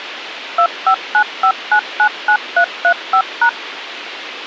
DTMF, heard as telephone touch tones, dialled by machine, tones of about 80 ms, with radio hiss. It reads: 2595999335#